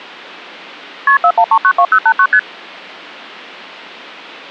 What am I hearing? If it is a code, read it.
Multi-frequency trunk signalling (R1, as on North American trunks), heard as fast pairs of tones, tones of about 70 ms. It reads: KP 41392089 ST